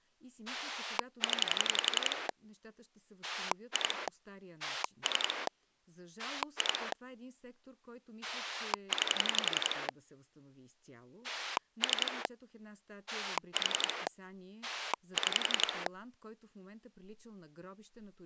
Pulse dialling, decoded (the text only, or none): 0 2 3 2 9 3 4 6